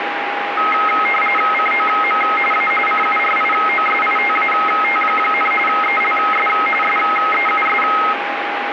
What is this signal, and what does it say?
RTTY (45.45 baud, 850 Hz shift), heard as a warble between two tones, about 1700 Hz centre, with radio static and a steady whistle near 810 Hz. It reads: COM A CURIOSITAT, ELS SEUS